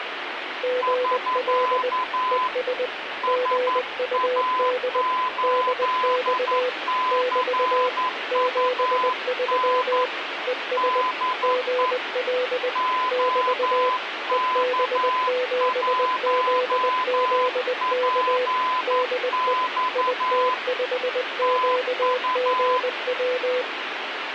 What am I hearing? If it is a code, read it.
Morse code, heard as two keyed tones, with radio static. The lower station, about 20 wpm, 500 Hz: GL ES GUD DX <BT> 73 ES GL <BT> EB7ZZK DE IT5QGW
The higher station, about 11 wpm, 1010 Hz: <SK> SA8CUN DE OK1PX TU